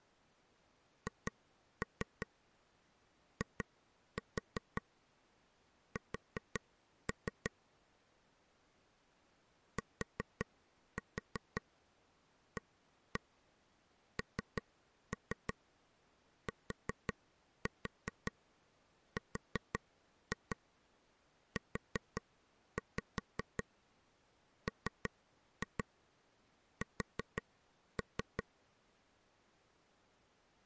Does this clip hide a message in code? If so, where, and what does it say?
Yes: tap code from 1.1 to 28.4 s, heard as taps on a table, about 5 knocks a second. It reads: HIS TANTRUMS